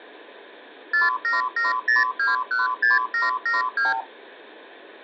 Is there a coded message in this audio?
Yes: multi-frequency trunk signalling (R2, with the far end's replies) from 0.9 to 4.0 s, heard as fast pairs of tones, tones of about 160 ms. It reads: 4770216772